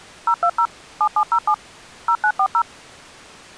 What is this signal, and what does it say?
DTMF, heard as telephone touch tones, dialled by machine, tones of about 70 ms. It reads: 020 7707 0940